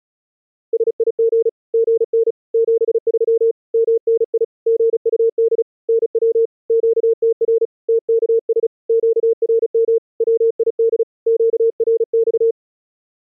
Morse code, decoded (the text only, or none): SIG GN 73 MNI GUD NW QTR TKS QRM WID QRX